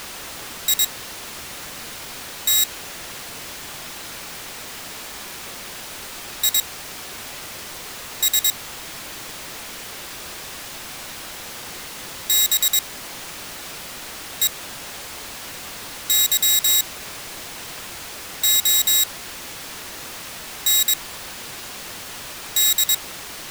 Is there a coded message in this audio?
Yes: Morse code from 0.6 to 23.0 s, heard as a high beeper, machine-sent, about 22 wpm, spaced as for 5 wpm, 3800 Hz. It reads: IT IS BEYOND